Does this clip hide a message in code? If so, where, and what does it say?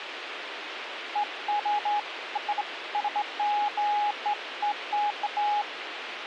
No, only beeps of irregular length, with radio hiss and a squelch burst at the end.